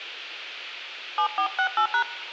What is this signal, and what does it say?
DTMF, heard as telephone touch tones, dialled by hand, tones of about 90 ms. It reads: 7468#